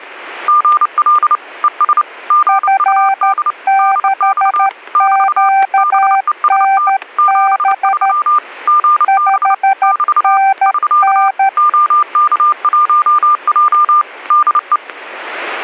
Morse code, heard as two keyed tones, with static crashes. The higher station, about 29 wpm, 1200 Hz: GL ES GUD DX <BT> BEST 73 GB <BT> <SK> OK1J DE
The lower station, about 13 wpm, 780 Hz: F6QNB 5NN